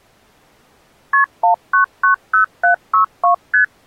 Multi-frequency trunk signalling (R1, as on North American trunks), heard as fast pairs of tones, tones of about 110 ms. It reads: KP 1990762 ST